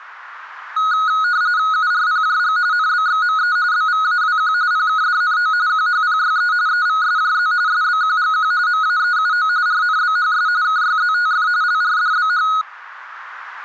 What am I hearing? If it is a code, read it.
RTTY (45.45 baud, 170 Hz shift), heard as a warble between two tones, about 1360 Hz centre. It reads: URPJG NBXME BVAWQ PKDNO QHPYE EVSJZ SBQGQ MAEUO RNBHS KYZTF LRDBH